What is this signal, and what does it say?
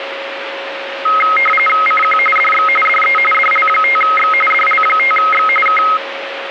RTTY (45.45 baud, 850 Hz shift), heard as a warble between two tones, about 1700 Hz centre, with radio static and a steady whistle near 550 Hz. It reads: CQ DX DE DL5X DL5X K